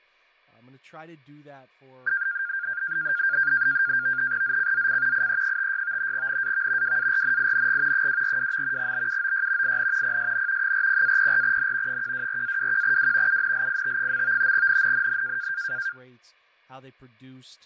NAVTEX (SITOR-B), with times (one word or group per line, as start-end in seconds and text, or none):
4.4-5.3 ZCZC
5.1-6.1 IE56
6.1-7.0 NAV
6.8-8.1 WARNING
7.9-8.9 242.
8.8-9.8 BUOY
9.6-10.2 IN
10.0-10.7 PSN
10.6-12.0 40-04N
11.9-13.4 124-21W
13.3-14.5 UNLIT.
14.5-15.5 NNNN